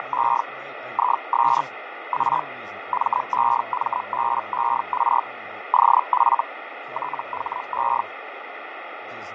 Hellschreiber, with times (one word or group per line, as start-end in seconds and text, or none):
0.0-0.4 …
0.9-1.6 IS
2.1-2.4 A
2.9-5.2 MEMBER
5.7-6.4 OF
6.9-8.0 THE